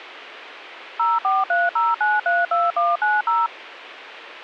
DTMF, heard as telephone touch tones, dialled by machine, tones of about 190 ms. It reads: 0430932190